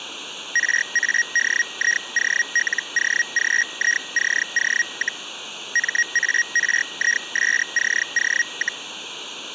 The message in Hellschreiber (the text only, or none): RADIOLOGICO, MARISCO,